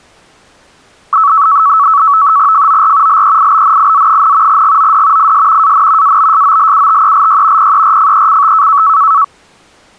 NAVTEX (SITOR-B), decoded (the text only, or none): FOR LEIBNIZ, GOD IS AN ABSOLUTELY PERFECT